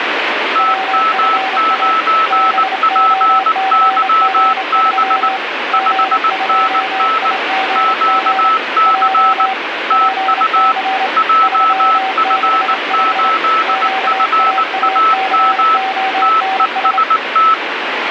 Morse code, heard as two keyed tones, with radio static. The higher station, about 19 wpm, 1310 Hz: TM9PYB 5NN QC TU JF8FAM TEST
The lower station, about 28 wpm, 770 Hz: WFA BOCG3 G2IGG J PC 365 QAACONS